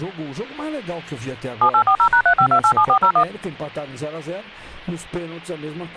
DTMF, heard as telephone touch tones, dialled by machine, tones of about 80 ms. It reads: 7840#35287401